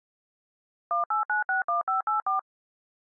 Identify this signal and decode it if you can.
DTMF, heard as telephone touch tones, dialled by machine, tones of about 130 ms. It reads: 18961584